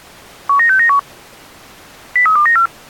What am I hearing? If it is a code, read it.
Five-tone selective call (CCIR), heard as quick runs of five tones, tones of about 100 ms. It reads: 19691 03294